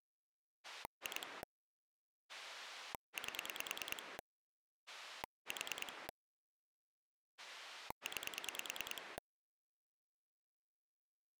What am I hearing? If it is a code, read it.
Pulse dialling, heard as a rotary dial, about 9 pulses a second. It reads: 2 8 4 9